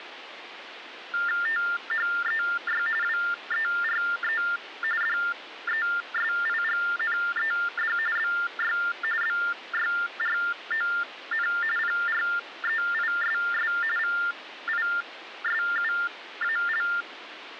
TTY/TDD text telephone tones (45.45 baud Baudot), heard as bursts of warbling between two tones, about 400 Hz shift, 1600 Hz centre, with phone line noise. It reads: THEY WERE DESIGNED BY BYRON PREISS VISUAL